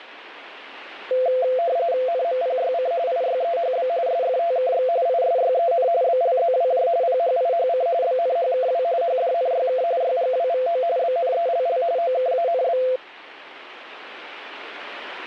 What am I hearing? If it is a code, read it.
RTTY (45.45 baud, 170 Hz shift), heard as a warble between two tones, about 600 Hz centre. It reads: NMPYC IYEHB SFTKX ISYEN BLZWJ PHIHC BNHKW HDNYK YGWVO BNELL OKANB